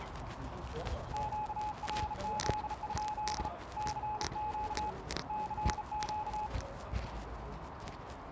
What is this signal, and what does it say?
Morse code, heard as a keyed tone, hand-sent with a bug key, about 35 wpm, 850 Hz, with radio static, a narrow filter and the noise of a residential street. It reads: QRZ? CQ CQ